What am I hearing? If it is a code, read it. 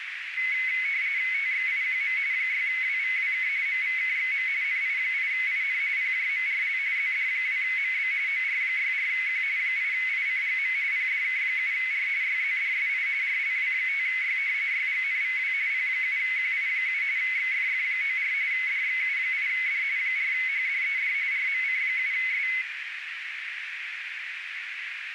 RTTY (45.45 baud, 170 Hz shift), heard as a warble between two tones, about 2150 Hz centre, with radio static and a narrow filter. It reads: TXIQM 6WVWK MVKXM NI8IN PJMRL ZD2MB OR64Q 8ICGM PDK7R YZDSI RLW5Y YGNVW P7QI7 XFF94 DXU8D 4HDED RMC7S